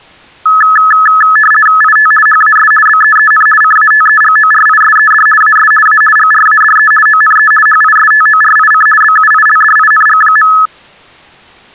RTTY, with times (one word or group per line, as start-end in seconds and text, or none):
1.8-2.1 IT
2.3-2.7 HAS
2.9-3.5 BEEN
3.6-5.3 CATEGORISED
5.4-5.7 AS
5.9-6.0 A
6.2-6.9 GRADE
7.1-7.5 ONE
7.7-8.9 HISTORIC
9.0-10.5 BUILDING.